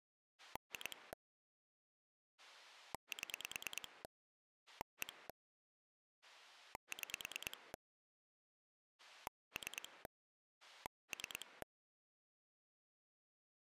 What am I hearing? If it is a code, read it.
Pulse dialling, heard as a rotary dial, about 9 pulses a second. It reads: 2 7 1 6 3 3